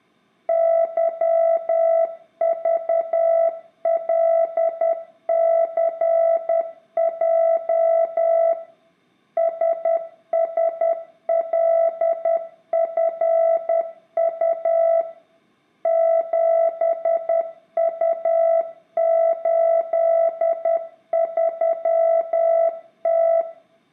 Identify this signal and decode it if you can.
Morse code, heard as a keyed tone, machine-sent, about 10 wpm, 660 Hz, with room echo. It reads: YVLCJ SSLFU 7U83T